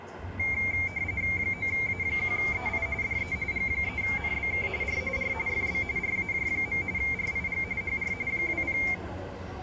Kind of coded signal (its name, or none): RTTY